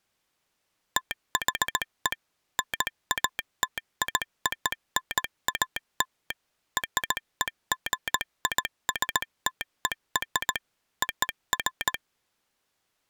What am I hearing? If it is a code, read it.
Morse code (American railroad code), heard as a telegraph sounder, machine-sent. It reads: THE NATIONAL REGISTER OF